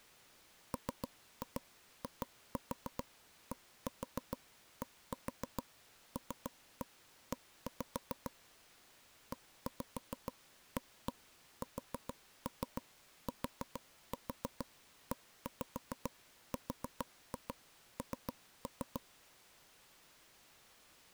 Tap code, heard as taps on a table, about 6 knocks a second. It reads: MIDDLE EASTERN